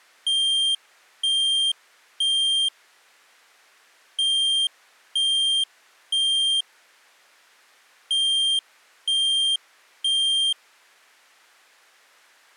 Alarm pattern, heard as an alarm's beeps, played three times, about 3200 Hz. Temporal three. Smoke or fire, evacuate.